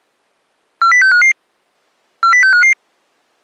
Five-tone selective call (CCIR), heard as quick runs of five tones, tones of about 100 ms. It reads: 40655 40655